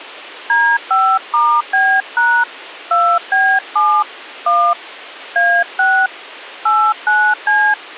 DTMF, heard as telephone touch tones, dialled by hand, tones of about 270 ms. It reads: D5*B# 2B7 1 A6 89C